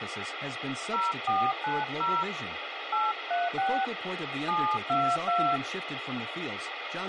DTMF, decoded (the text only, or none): 0490 836 722